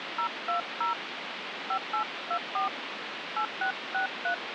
DTMF, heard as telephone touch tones, dialled by hand, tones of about 100 ms, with phone line noise. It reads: 020 5824 8663